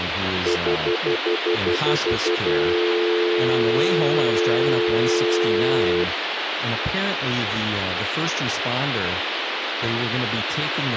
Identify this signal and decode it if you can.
Telephone call progress tone (North American plan), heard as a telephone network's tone, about 350, 440 Hz, 0.1 s on and 0.1 s off, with phone line noise and speech in English. Stutter dial tone.